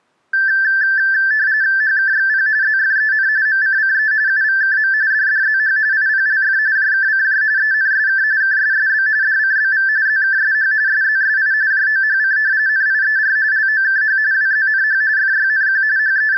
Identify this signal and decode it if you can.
RTTY (45.45 baud, 170 Hz shift), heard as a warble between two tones, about 1650 Hz centre. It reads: HKXP ZFEN MCCE UVKM DDZH IPLF JKCJ ENSK KSSB DCBV ZKSH SZSI JOHC NIER LOKH WZNH FYNQ …